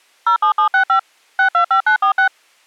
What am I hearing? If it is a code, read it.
DTMF, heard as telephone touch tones, dialled by machine, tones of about 100 ms. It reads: 07765 625946